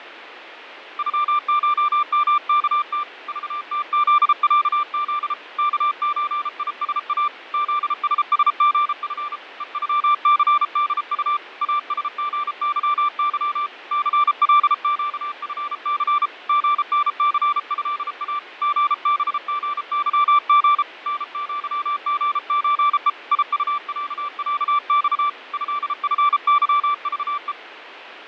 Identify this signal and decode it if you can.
Morse code (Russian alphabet), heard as a keyed tone, hand-sent with a paddle, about 33 wpm, 1180 Hz, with radio static and fading. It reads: ЮШМКТ ЖТЗЯЗ КЧИСА ЗССГФ ЕЮЦДУ АСГЫЫ ЦЛЩФЦ ГНЦЭА ГБГЫГ НЪГЧЕ ИУЯЯЬ ЭФЫЖЕ